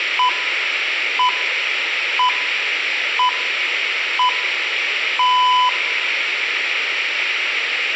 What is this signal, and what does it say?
Radio time signal (six pips, as the Greenwich Time Signal), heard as pips, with room echo.